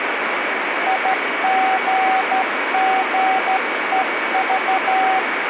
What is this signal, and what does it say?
Morse code, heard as a keyed tone, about 13 wpm, 760 Hz, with radio static and a steady whistle near 2260 Hz. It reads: IGGEV